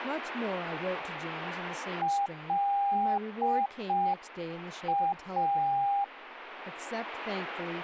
Morse code, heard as a keyed tone, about 5 wpm, 800 Hz, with radio static and speech in English. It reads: LA